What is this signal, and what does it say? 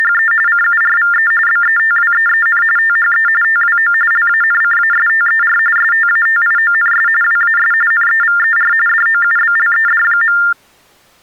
TTY/TDD text telephone tones (45.45 baud Baudot), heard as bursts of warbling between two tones, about 400 Hz shift, 1600 Hz centre. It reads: … CURVE BETWEEN THE TWO LANCASTER STATIONS WAS NEVER DOUBLED.